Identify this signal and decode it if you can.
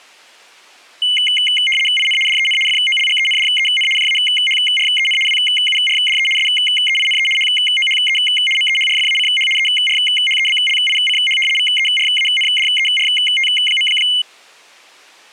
RTTY (75 baud, 850 Hz shift), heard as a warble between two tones, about 2550 Hz centre. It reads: IN DEN FOLGENDEN JAHREN WURDE SEINE HOHE MEHRFACH ERHEBLICH VERANDERT.